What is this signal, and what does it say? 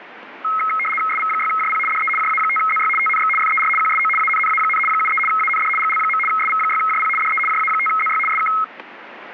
RTTY (75 baud, 850 Hz shift), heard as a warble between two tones, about 1700 Hz centre, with radio static. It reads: SV6JP DE JA5ZY TNX FER QSO ANNA, 73 AND GL. SV6JP DE JA5ZY SK